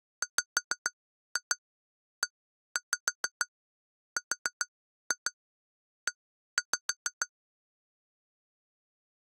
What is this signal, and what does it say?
Tap code, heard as taps on glass, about 6 knocks a second. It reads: WERE